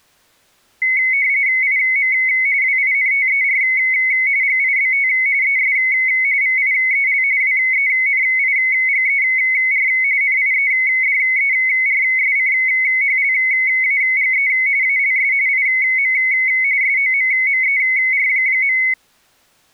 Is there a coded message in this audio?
Yes: RTTY (45.45 baud, 170 Hz shift) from 0.8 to 18.9 s, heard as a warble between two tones, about 2150 Hz centre. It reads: IM WINTER GIBT ES VIEL WENIGER NIEDERSCHLAGE ALS IM SOMMER.